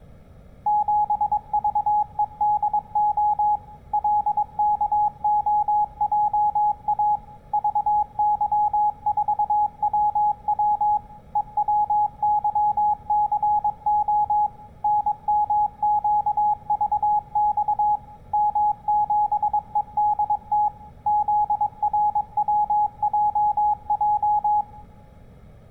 Morse code, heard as a keyed tone, machine-sent, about 22 wpm, 840 Hz, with room echo. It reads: 7VEDO LKOJA VY4WW EWYCO NMQVX M7EDT ZRWJJ